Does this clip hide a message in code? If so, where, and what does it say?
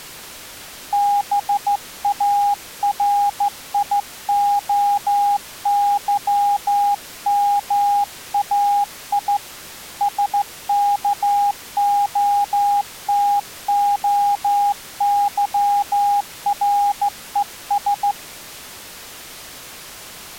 Yes: Morse code (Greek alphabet) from 0.9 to 18.2 s, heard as a keyed tone, hand-sent with a straight key, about 14 wpm, 810 Hz. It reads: ΒΑΡΙΟΥΜΑΙ ΣΚΟΤΟΥΡΕΣ